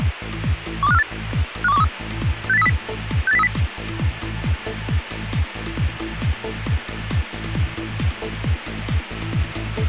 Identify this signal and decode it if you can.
Five-tone selective call (EEA), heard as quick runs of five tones, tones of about 40 ms, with radio hiss. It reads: 12548 51213 68030 68030